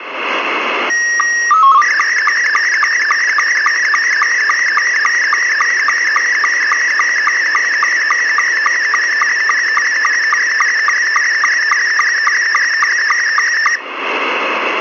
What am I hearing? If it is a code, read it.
SSTV (slow-scan television), Scottie S2, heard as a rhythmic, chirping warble, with radio static.